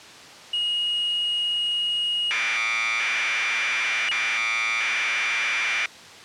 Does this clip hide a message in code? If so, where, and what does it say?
Yes: Commodore tape loading (standard loader) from 0.5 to 5.9 s, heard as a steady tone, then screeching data.